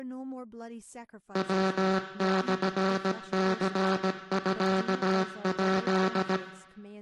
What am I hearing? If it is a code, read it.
Morse code (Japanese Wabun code), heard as a buzzer, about 17 wpm, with room echo and speech in English. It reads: ヤモニミヱ